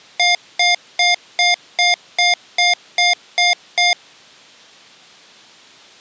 Beep code, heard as beeps from a small speaker, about 710 Hz. 10 short. In AMI BIOS tables: CMOS shutdown register error.